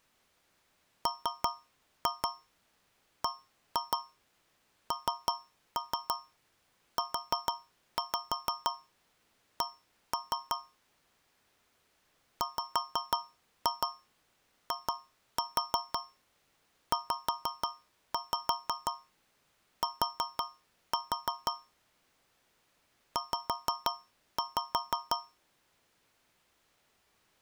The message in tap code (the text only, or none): MBNUC WIZT Z